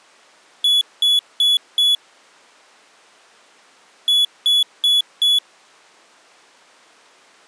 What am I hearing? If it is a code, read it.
Beep code, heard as a piezo beeper, played twice, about 3400 Hz. 4 short. In AMI BIOS tables: system timer failure; in Dell tables: memory read or write failure.